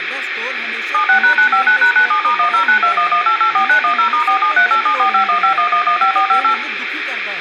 DTMF, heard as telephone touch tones, dialled by machine, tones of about 100 ms, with radio hiss, room echo and speech in Punjabi. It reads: 76#959#97*109211884910*4738745151115458